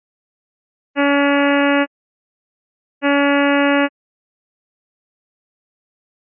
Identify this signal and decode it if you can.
Ship horn signal, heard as a ship's horn, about 280 Hz. 2 short. At sea: I am altering course to port.